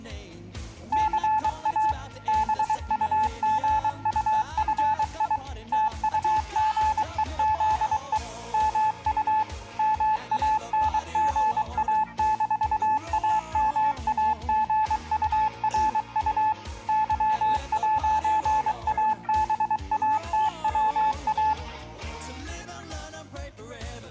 Morse code, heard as a keyed tone, machine-sent, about 23 wpm, 870 Hz. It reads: CA BUGUFI TUGEZE MU MANGA-AMAGURU Y'ABATWA